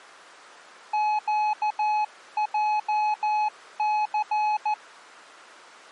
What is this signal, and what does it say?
Morse code, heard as a keyed tone, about 14 wpm, 850 Hz. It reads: QJC